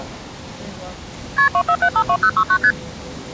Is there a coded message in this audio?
Yes: multi-frequency trunk signalling (R1, as on North American trunks) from 1.4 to 2.7 s, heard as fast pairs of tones, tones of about 70 ms, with street noise. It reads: KP 24752069 ST